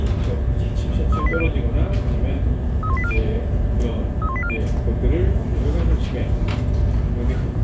Five-tone selective call (ZVEI), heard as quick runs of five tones, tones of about 70 ms, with the noise of a crowd indoors. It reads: 31840 31840 31840